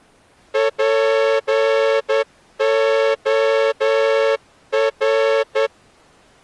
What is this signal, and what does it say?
Morse code, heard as a horn, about 10 wpm. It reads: POR